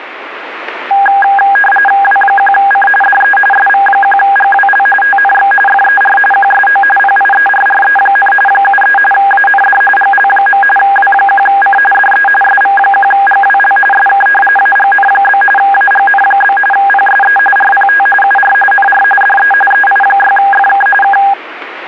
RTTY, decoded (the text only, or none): W1C DE SV1GWL TNX FER QSO PIERRE, 73 AND GL. W1C DE SV1GWL SK AGN? AGN? PSE RPT UR NR DE EI6FK K